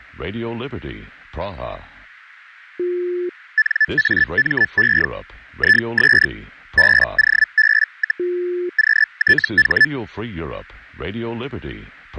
Hellschreiber (Feld-Hell, 122.5 baud), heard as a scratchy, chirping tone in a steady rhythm, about 1750 Hz. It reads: NAME IS BOB, QTH